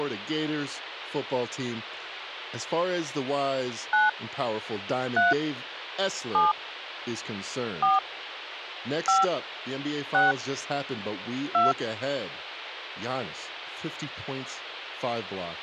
DTMF, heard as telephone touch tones, dialled by hand, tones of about 170 ms, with phone line noise and speech in English. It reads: 9 3 7 4 5 6 2